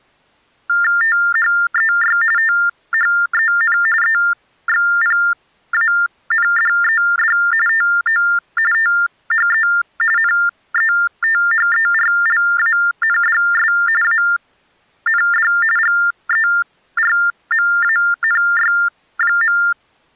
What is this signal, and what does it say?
TTY/TDD text telephone tones (45.45 baud Baudot), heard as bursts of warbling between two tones, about 400 Hz shift, 1600 Hz centre. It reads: THEY THEN EXPANDED TO THE NETHERLANDS AND GERMANY.